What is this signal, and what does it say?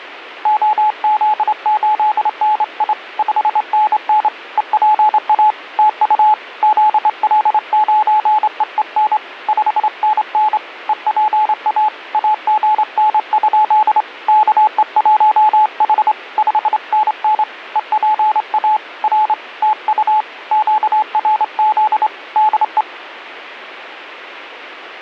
Morse code, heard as a keyed tone, hand-sent with a straight key, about 27 wpm, 860 Hz. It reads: OZ8NI 5NN EPA TU ZL9EEN 5NN EPA AGN? KE1H 5NN EPA R TU QRZ DE